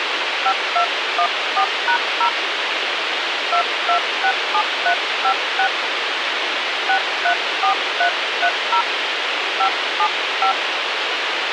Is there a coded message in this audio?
Yes: DTMF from 0.5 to 10.5 s, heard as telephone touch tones, dialled by hand, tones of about 90 ms, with radio hiss. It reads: 5214#0 2267356 634330 575